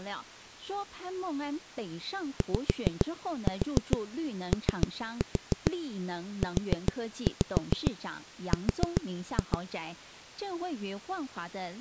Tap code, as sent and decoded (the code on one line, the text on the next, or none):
5-4 3-4 4-5 4-2
YOUR